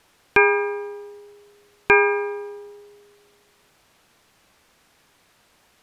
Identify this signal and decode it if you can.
Clock strike, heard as a bell. 2. Two o'clock.